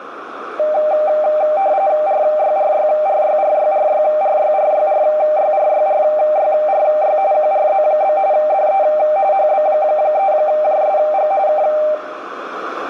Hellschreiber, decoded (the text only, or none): none